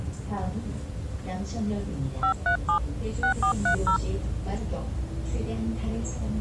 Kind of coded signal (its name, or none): DTMF